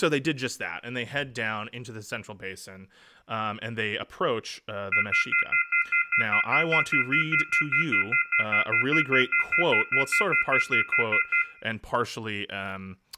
Telephone call progress tone (North American plan), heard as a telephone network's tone, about 1400, 2050, 2450, 2600 Hz, 0.1 s on and 0.1 s off, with room echo and speech in English. Off-hook warning tone.